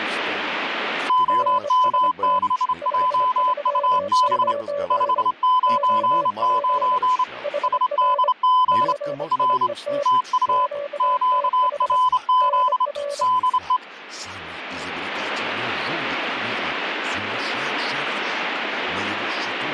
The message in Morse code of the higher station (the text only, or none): OM6JUB 599 SDG R TU QRZ DE